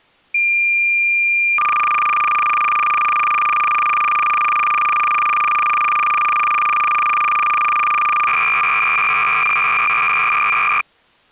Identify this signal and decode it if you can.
Cassette data (Kansas City type), 300 baud, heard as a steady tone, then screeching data.